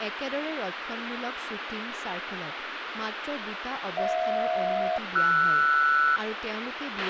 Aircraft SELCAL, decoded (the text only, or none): HJ-RS